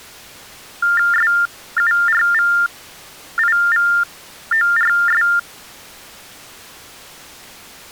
TTY/TDD text telephone tones (45.45 baud Baudot), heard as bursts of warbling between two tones, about 400 Hz shift, 1600 Hz centre. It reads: SURVIVORS